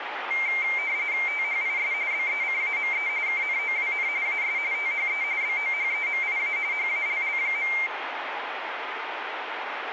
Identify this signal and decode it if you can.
RTTY (45.45 baud, 170 Hz shift), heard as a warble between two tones, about 2200 Hz centre, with radio static and room echo. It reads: THIS BECAME KNOWN AS THE BOHEMIA HALL.